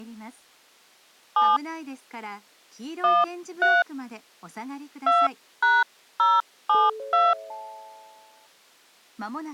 DTMF, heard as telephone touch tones, dialled by hand, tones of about 200 ms. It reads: 7 13 2#072